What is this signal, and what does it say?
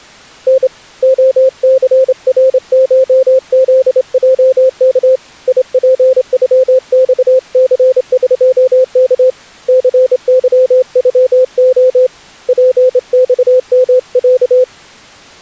Morse code (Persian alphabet), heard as a keyed tone, hand-sent with a straight key, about 27 wpm, 520 Hz. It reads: ن عثرشزجک یپغخثقک ثظغع پخمص